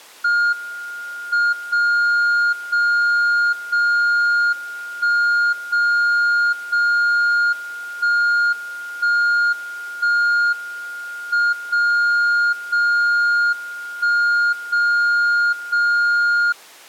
Radio time signal (WWVB), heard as a tone whose level steps once a second, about 1420 Hz. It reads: M 0 0 0 1 0 0 1 1 1 M 0 0 1 0 0